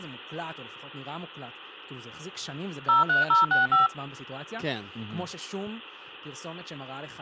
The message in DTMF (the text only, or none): 03065